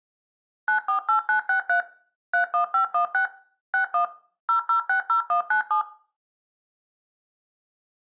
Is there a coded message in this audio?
Yes: DTMF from 0.7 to 5.8 s, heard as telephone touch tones, dialled by machine, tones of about 110 ms, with room echo. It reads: 948963 31516 61 0060197